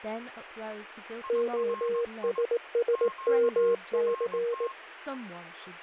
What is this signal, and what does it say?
Morse code, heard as a keyed tone, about 18 wpm, 470 Hz, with a weaker station near 1070 Hz and speech in English. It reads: OSSMC